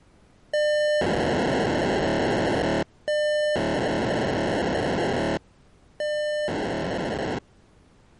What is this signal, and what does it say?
POCSAG pager data (1200 baud), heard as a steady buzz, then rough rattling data.